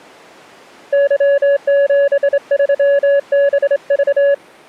Morse code, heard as a keyed tone, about 26 wpm, 560 Hz. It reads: Y73BV